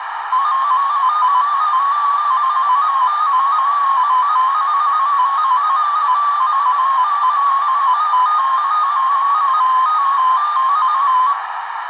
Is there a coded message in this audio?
Yes: multi-tone FSK (Olivia or MFSK type), about 250 Hz wide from 0.3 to 11.3 s, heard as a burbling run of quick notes, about 15.625 baud, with radio static, a narrow filter and room echo.